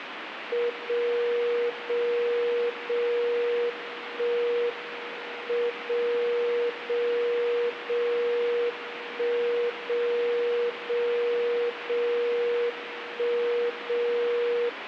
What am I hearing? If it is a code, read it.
Radio time signal (WWVB), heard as a tone whose level steps once a second, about 480 Hz, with radio static. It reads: 0 0 0 1 M 0 0 0 1 0 0 0 1 0